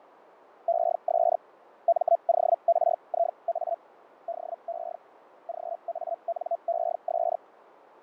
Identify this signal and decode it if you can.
Hellschreiber (Feld-Hell, 122.5 baud), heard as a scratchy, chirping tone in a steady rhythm, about 680 Hz, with radio static and fading. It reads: ES MORIA DE GANES